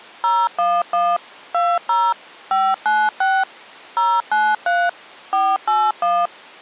DTMF, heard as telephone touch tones, dialled by machine, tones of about 230 ms. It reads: 011 20 596 093 481